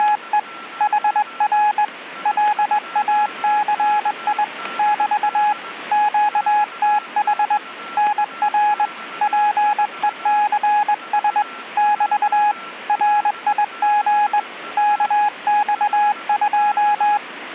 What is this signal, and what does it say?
Morse code, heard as a keyed tone, hand-sent with a straight key, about 21 wpm, 840 Hz, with radio static and a weaker station near 1350 Hz. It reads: … HR LACI <BT> QTH NR PECS <BT> RIG KX2